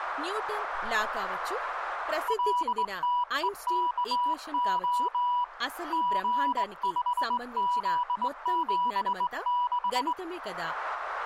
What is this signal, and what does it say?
Morse code, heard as a keyed tone, hand-sent with a straight key, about 20 wpm, 980 Hz, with radio static and speech in Telugu. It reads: LTEKO G5Z76